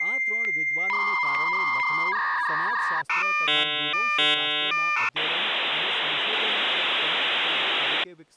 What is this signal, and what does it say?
Dial-up modem handshake (V.34 or later), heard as a whistle, warbles, then hiss, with speech in Gujarati.